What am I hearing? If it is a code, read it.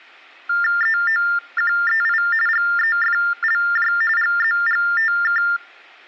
TTY/TDD text telephone tones (45.45 baud Baudot), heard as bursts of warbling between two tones, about 400 Hz shift, 1600 Hz centre. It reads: EOQEI GEFLJ GZGTK